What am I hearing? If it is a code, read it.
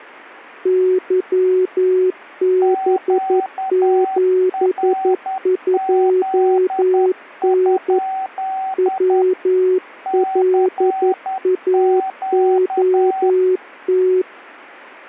Morse code, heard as two keyed tones. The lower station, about 11 wpm, 370 Hz: YB72N WLAOT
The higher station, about 10 wpm, 760 Hz: QRZ? CQ